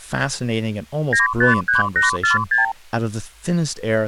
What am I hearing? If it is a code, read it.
Multi-frequency trunk signalling (R2, with the far end's replies), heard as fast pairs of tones, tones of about 140 ms, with speech in English. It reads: 953846